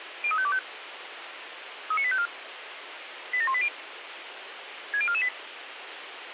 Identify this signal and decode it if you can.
Five-tone selective call (ZVEI), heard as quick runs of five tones, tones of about 70 ms, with radio hiss. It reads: 03525 39854 87180 60448